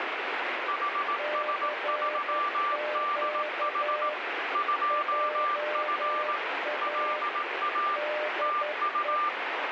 Morse code, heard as two keyed tones, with heavy radio static. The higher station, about 18 wpm, 1180 Hz: HS3DH 2F LA TU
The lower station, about 11 wpm, 600 Hz: CQ JA DE